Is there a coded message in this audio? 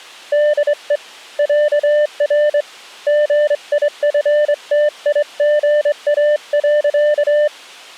Yes: Morse code (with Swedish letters) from 0.3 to 7.5 s, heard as a keyed tone, hand-sent with a straight key, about 23 wpm, 600 Hz. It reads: DE ÄR GIFTIGA.